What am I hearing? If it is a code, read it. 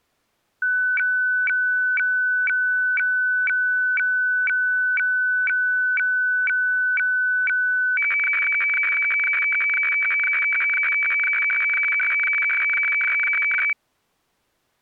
Weather fax (radiofax), 120 lines a minute, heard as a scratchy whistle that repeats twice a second.